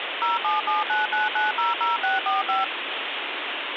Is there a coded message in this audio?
Yes: DTMF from 0.2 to 2.6 s, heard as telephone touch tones, dialled by machine, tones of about 160 ms, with phone line noise. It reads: 07799900645